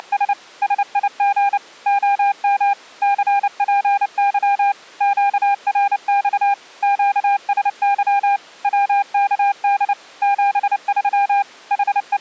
Morse code, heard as a keyed tone, machine-sent, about 29 wpm, 800 Hz. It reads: … SIG OM CPY QRX QSY WKD 73 …